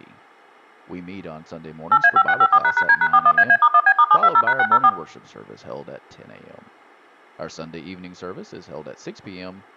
DTMF, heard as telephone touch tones, dialled by machine, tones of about 60 ms, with speech in English. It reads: 8A5654##D#41AA*1B*720#604